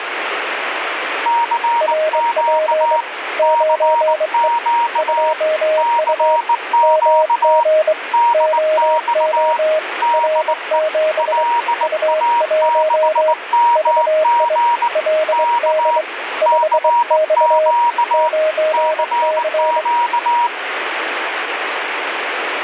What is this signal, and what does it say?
Morse code, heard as two keyed tones, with radio static. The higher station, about 19 wpm, 950 Hz: CQ CQ CQ DX DE LA6MG K CQ CQ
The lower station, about 23 wpm, 620 Hz: RP 9E 2U MG OO R7 U1 VI LD 5X 9C